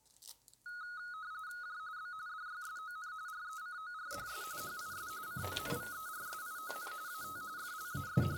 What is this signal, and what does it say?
RTTY (45.45 baud, 170 Hz shift), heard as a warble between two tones, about 1360 Hz centre, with kitchen noise. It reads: J B DYSON RECORDS HIS CONVERSION AT …